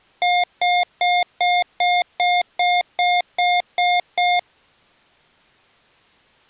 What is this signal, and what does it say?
Beep code, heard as beeps from a small speaker, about 710 Hz. 11 short. In AMI BIOS tables: cache memory error.